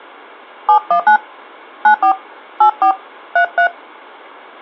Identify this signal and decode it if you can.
DTMF, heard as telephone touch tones, dialled by hand, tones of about 100 ms. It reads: 719 94 84 33